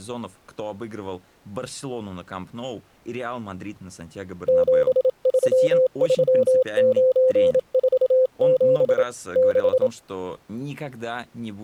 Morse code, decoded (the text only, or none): 733947 6